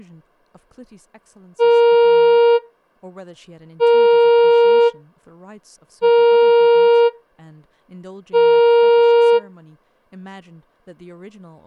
Ship horn signal, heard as a ship's horn, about 470 Hz, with speech in English. 4 short. At sea: a pilot vessel's identity signal in fog.